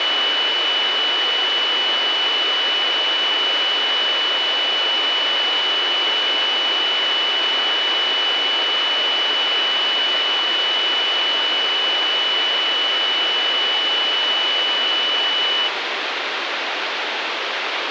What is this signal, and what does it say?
A steady tone, with radio hiss and a squelch burst at the end. There is no code.